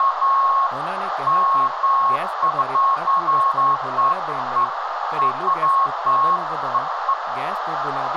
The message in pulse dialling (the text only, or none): none